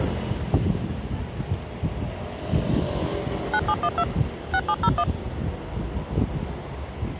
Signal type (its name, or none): DTMF